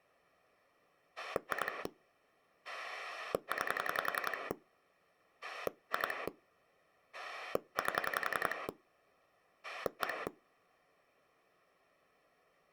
Pulse dialling, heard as a rotary dial, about 11 pulses a second. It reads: 2 9 2 8 1